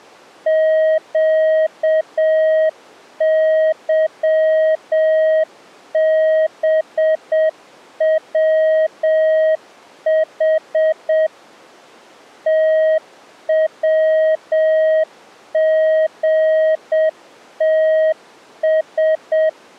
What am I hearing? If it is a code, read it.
Morse code, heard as a keyed tone, machine-sent, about 7 wpm, 630 Hz. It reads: QYBWH TWGTS